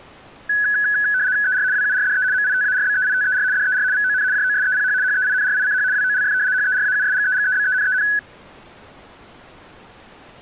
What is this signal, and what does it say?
RTTY (75 baud, 170 Hz shift), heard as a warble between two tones, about 1600 Hz centre. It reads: ER WURDE MITARBEITER DER VON JOSEPH HEINRICH WOLF HERAUSGEGEBENEN